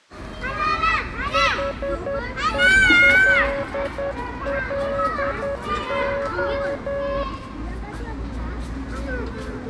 Morse code, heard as a keyed tone, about 10 wpm, 560 Hz, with the noise of a park. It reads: HELLO